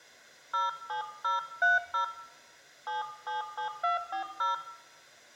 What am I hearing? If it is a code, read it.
DTMF, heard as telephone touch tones, dialled by hand, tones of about 130 ms, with room echo. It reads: 07030 777240